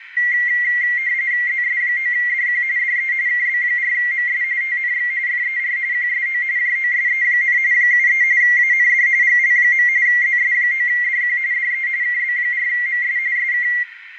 RTTY (45.45 baud, 170 Hz shift), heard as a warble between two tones, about 2050 Hz centre, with radio static, a narrow filter and room echo. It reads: ZS9DQ DE KB4MS TNX FER QSO JOSE, 73 AND GL. ZS9DQ DE KB4MS SK